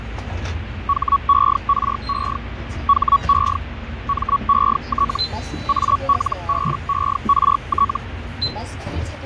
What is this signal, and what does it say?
Hellschreiber (Feld-Hell, 122.5 baud), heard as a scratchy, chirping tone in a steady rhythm, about 1120 Hz, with radio static, fading and the noise inside a bus. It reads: HERE HE MET ALBERT